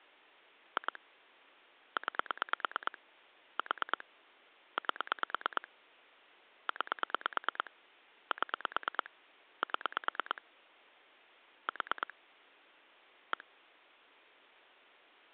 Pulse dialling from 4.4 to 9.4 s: 8 9 7

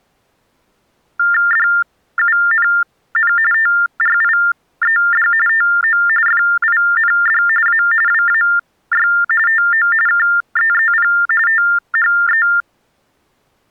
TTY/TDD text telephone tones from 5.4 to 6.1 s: TO

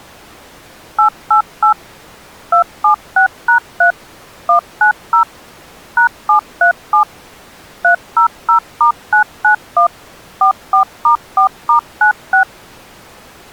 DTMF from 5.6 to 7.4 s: #737

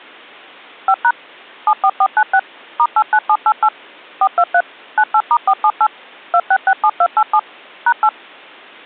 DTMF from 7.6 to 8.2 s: #8

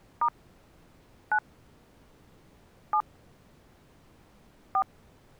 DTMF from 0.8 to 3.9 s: 9 7

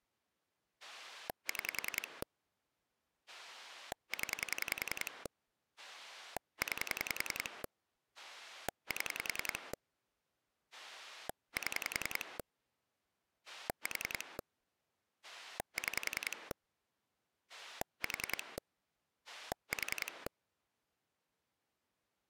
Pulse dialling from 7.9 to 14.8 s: 7 7 4

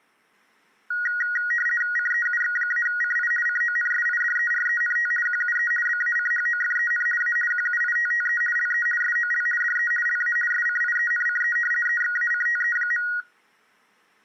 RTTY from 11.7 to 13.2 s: EXACTE.

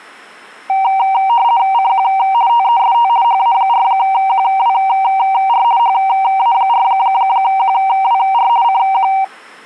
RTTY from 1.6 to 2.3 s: CQ

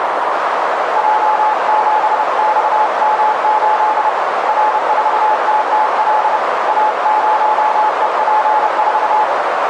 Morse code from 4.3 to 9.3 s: R4TTL A0EP4

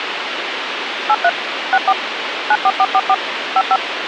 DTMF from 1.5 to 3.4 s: 64 94444

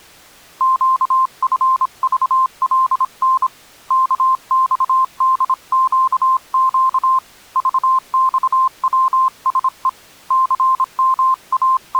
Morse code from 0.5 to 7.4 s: QFVLN KXDQQ

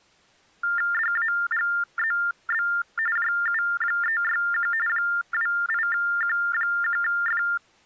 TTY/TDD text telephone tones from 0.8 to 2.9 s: DAGZB

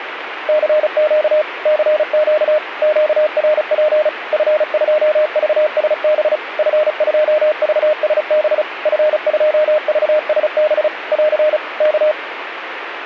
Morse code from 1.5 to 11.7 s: CQ QRP F2VSB F2VSB F2VSB <AR>

